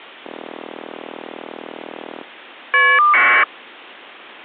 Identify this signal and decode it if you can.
Caller ID data burst, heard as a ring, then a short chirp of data, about 1200 baud.